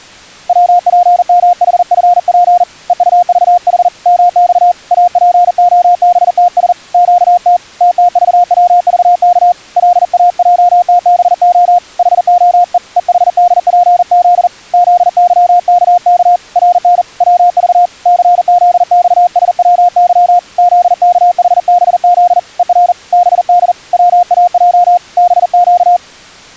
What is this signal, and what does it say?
Morse code, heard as a keyed tone, hand-sent with a paddle, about 40 wpm, 710 Hz. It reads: WPMHFP EUVH MX APOBTS QT TTVWVK LAJTBO HOE EHDPZ ZYKK RN WV CZXSWY ZKHBZ ER BD WAJ BQ